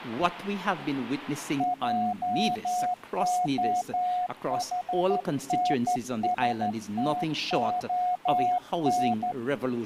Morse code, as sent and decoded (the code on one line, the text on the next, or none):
.--- --- .... -. ... - --- -.
JOHNSTON